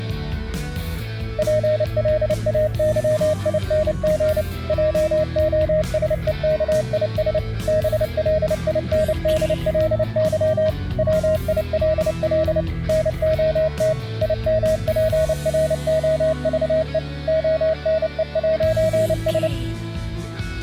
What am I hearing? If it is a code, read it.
Morse code, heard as a keyed tone, machine-sent, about 29 wpm, 630 Hz. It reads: PLAYING JOSEKIS BLINDLY WILL NOT IMPROVE ONE'S